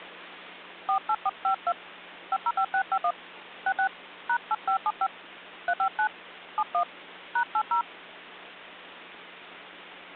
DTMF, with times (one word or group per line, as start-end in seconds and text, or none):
0.9-1.7 48452
2.3-3.1 505651
3.7-3.9 66
4.3-5.1 #8575
5.7-6.1 359
6.6-6.8 71
7.4-7.8 #80